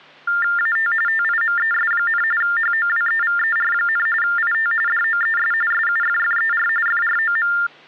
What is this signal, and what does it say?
TTY/TDD text telephone tones (45.45 baud Baudot), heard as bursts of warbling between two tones, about 400 Hz shift, 1600 Hz centre, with hum. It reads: AT TIMES, HOWEVER, IT DOES SUFFER FROM